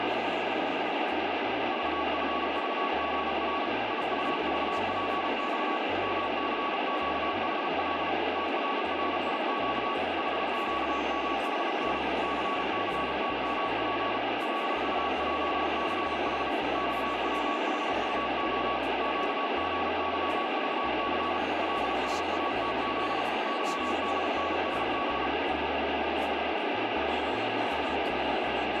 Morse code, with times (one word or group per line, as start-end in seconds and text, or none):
1.7-3.7 VFVGR
3.9-5.8 IUVPX
6.0-8.1 MCQHL
8.4-9.9 TRRIQ
10.2-12.0 HQMHN
12.2-14.2 CCTMP
14.4-16.5 LUJCH
16.8-18.8 XWHUO
19.0-21.4 QGYVC
21.6-23.2 LSATZ
23.5-25.3 YDNSB